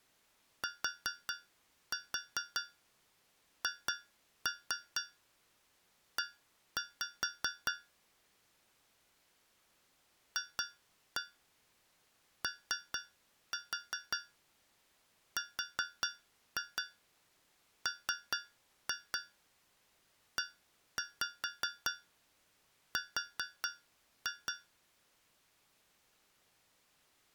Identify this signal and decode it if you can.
Tap code, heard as taps on a metal pipe, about 4 knocks a second. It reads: THE FORMER